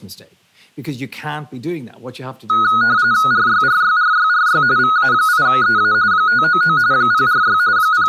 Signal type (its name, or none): RTTY